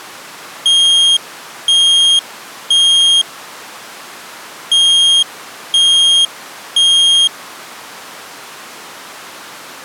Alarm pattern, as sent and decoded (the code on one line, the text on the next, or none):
3 beeps and a pause
temporal three